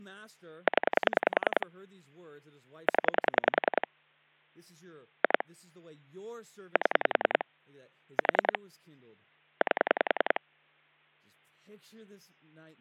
Pulse dialling, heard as clicks on a phone line, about 10 pulses a second, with speech in English. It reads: 0 0 2 7 4 8